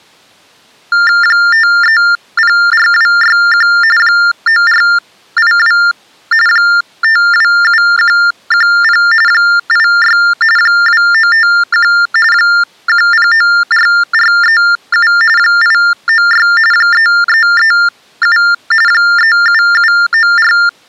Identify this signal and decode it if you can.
TTY/TDD text telephone tones (45.45 baud Baudot), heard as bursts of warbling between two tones, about 400 Hz shift, 1600 Hz centre. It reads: 5304261 9482 527110 86 2951 1094437 896 3337 37794